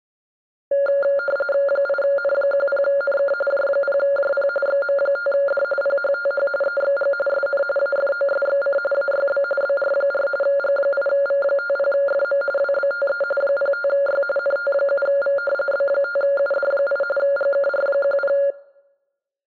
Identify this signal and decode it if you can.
RTTY (45.45 baud, 850 Hz shift), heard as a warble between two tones, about 980 Hz centre. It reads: 8N10NK J0JP XM5D PHTH EXG SN AFOSXC AYB BR4 G8V50FM WBTE 05Y NT7V B5UD8 GKR10